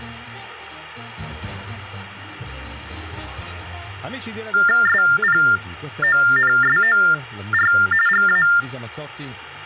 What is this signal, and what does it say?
TTY/TDD text telephone tones (45.45 baud Baudot), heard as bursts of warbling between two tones, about 400 Hz shift, 1600 Hz centre. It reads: SPONSOR GA